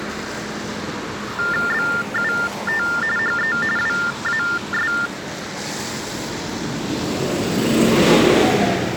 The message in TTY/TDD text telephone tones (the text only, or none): BUT HE WAS